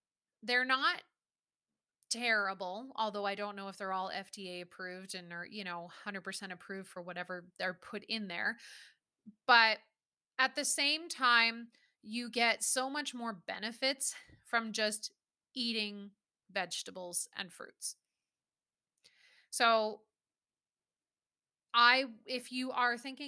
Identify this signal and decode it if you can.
Speech in English. There is no code.